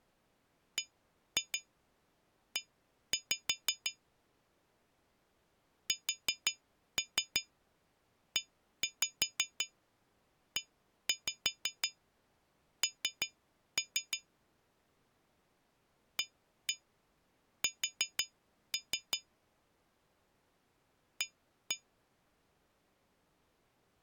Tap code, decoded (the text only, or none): BE SEEN AS A